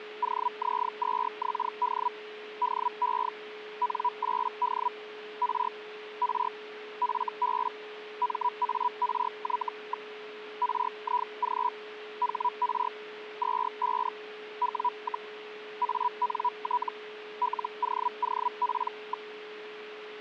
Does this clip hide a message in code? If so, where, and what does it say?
Yes: Hellschreiber (Feld-Hell, 122.5 baud) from 0.2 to 19.3 s, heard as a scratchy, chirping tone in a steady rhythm, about 980 Hz, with radio static and a steady whistle near 420 Hz. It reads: OZ2XD DE N8D R R FB MARY. RIG HR 25 W, ANT LOOP.